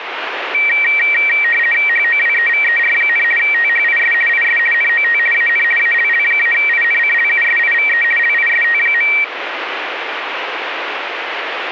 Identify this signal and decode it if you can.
RTTY (50 baud, 450 Hz shift), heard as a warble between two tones, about 2100 Hz centre, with radio static. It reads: HOWEVER, THIS IS NOT AN ALL-INCLUSIVE LIST.